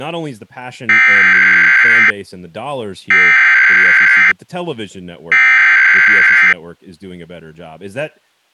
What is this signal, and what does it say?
Emergency Alert System (SAME) tones (header bursts), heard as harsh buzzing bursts, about 520.83 baud, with speech in English.